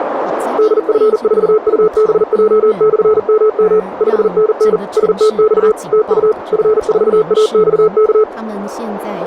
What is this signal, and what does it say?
Morse code, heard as a keyed tone, machine-sent, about 40 wpm, 430 Hz, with radio static, a narrow filter and speech in Chinese. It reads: DF4UBJ/MM 5NN STX TU F4AXK